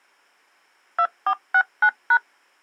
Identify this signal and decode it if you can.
DTMF, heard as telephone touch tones, dialled by machine, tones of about 70 ms. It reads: 2469#